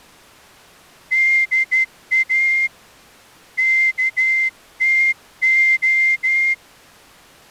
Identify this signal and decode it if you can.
Morse code (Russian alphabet), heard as a whistle, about 12 wpm. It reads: ДА КТО